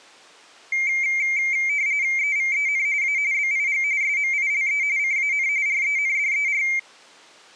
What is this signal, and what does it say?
RTTY (45.45 baud, 170 Hz shift), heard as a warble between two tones, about 2200 Hz centre. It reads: EVEN A BIG SMILE CAN RENDER